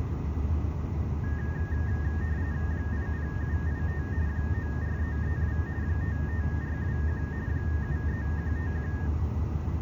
RTTY (45.45 baud, 170 Hz shift), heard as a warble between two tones, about 1750 Hz centre, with room echo and the noise inside a car. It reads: 80785 94332 55421 73151